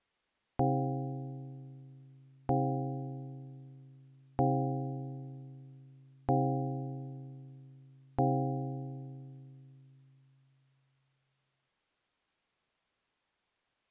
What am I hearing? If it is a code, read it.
Clock strike, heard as a bell. 5. Five o'clock.